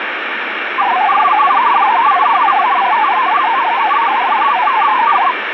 Multi-tone FSK (Olivia or MFSK type), about 500 Hz wide, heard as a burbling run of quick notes, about 62.5 baud, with radio static.